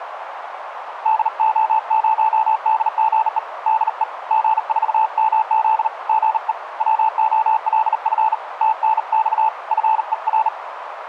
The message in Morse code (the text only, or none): DO0DGE DE G4MZ GE WOLF TNX FER